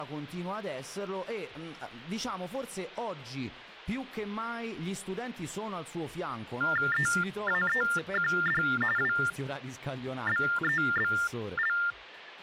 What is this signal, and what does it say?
TTY/TDD text telephone tones (45.45 baud Baudot), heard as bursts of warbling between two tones, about 400 Hz shift, 1600 Hz centre. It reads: EAEQD WBEBL